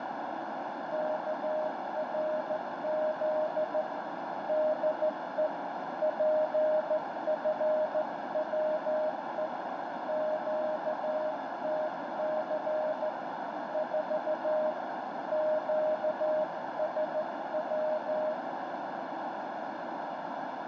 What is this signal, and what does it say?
Morse code, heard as a keyed tone, hand-sent with a straight key, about 14 wpm, 620 Hz, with heavy radio static and a narrow filter. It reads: KRZ DE PFWE QTC 4 QSW